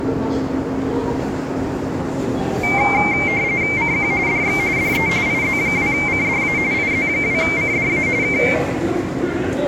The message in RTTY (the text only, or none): CQ DX DE IZ2CDA IZ2CDA K